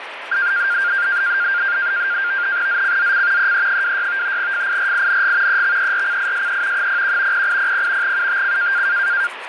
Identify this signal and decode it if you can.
NAVTEX (SITOR-B), 100 baud, 170 Hz shift, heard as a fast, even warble, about 1500 Hz centre, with radio static and the noise of a restroom. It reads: ZCZC EE26 FIRING EXERCISE 01 0800 UTC